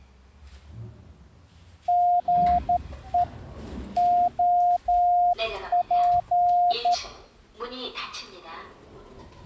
Morse code, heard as a keyed tone, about 12 wpm, 710 Hz, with the noise inside a lift. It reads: GE OP